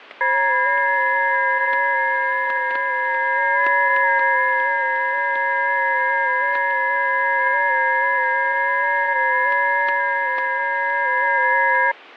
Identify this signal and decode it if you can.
FT8 (several signals at once), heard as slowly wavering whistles, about 6.25 baud, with static crashes.